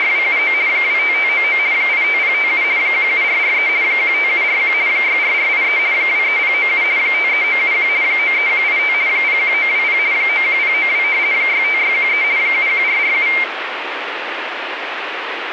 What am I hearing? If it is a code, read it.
RTTY (50 baud, 170 Hz shift), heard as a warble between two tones, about 2200 Hz centre, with radio static. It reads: … 25599 85057 17443 15741 64483 23097 53971 93185 01920 91092 65613 71447